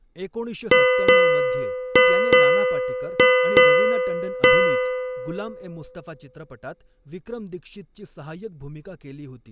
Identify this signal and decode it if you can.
Ship's bell, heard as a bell, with speech in Marathi. 7. Seven half-hours of the watch have passed.